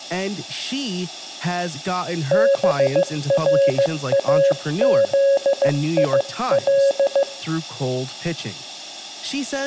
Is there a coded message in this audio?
Yes: Morse code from 2.3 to 7.3 s, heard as a keyed tone, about 15 wpm, 550 Hz, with speech in English. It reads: BRAZIL